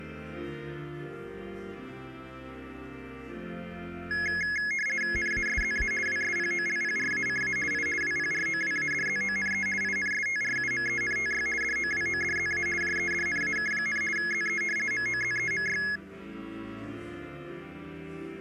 RTTY (50 baud, 450 Hz shift), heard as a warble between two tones, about 1900 Hz centre. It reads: NASZA WSPOLPRACA I WPROWADZONE INSTRUMENTY DOWODZA JEDNAK, ZE MOZEMY